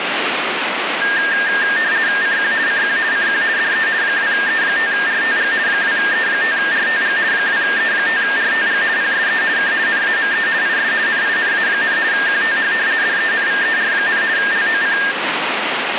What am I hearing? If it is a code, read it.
RTTY (50 baud, 170 Hz shift), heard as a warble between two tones, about 1700 Hz centre, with radio static. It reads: CQ CQ CQ DE 2E5RTG 2E5RTG 2E5RTG PSE K NAME IS NINA, QTH DENVER, LOC